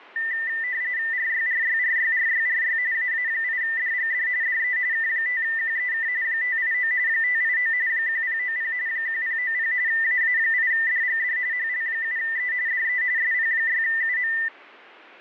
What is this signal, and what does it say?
RTTY (45.45 baud, 170 Hz shift), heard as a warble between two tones, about 1900 Hz centre. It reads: RYRYRYRYRY AA8DGD DE K5QEK 589 589 1090 1090 AA8DGD HL7E DE SP6UM